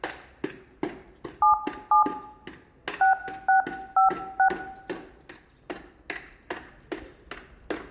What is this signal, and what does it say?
DTMF, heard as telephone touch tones, dialled by hand, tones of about 110 ms, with room echo and the noise of a residential street. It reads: 77 6656